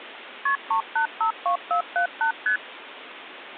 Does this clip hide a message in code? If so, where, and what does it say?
Yes: multi-frequency trunk signalling (R1, as on North American trunks) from 0.5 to 2.6 s, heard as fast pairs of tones, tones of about 100 ms, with phone line noise. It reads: KP 3852478 ST